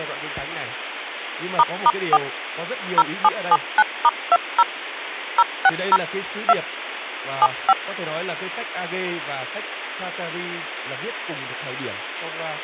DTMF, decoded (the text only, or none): **4 0779*20 060 2 75